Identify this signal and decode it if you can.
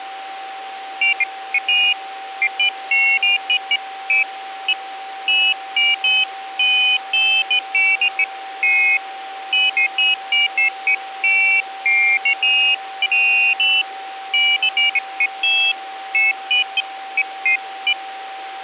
Pairs of high tones at irregular times, with a steady whistle near 770 Hz. There is no code.